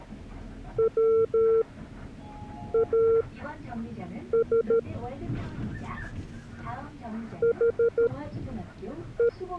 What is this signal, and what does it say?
Morse code, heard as a keyed tone, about 13 wpm, spaced as for 6 wpm, 460 Hz, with the noise inside a bus. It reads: WAS HE